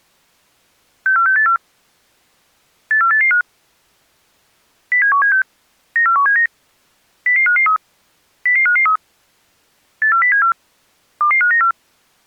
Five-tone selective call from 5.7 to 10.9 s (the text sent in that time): 94179 00553 00553 84074